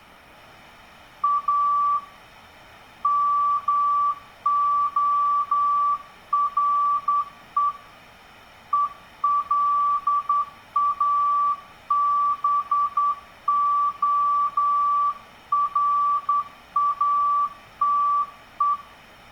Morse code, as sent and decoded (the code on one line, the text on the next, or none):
.- / -- --- .-. . / . .-.. .- -... --- .-. .- - .
A MORE ELABORATE